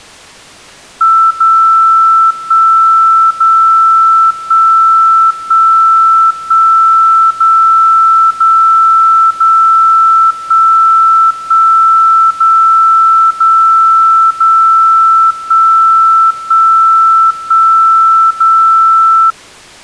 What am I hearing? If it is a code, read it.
Radio time signal (DCF77), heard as a tone whose level steps once a second, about 1330 Hz. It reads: 0 1 0 1 1 1 0 0 0 1 1 0 0 0 1 1 1 0